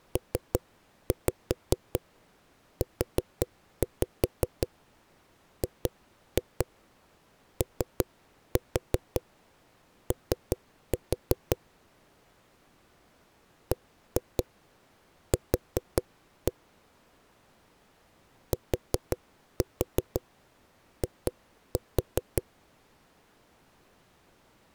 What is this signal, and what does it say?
Tap code, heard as knocks on a wall, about 5 knocks a second. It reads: PUGOO BQ TI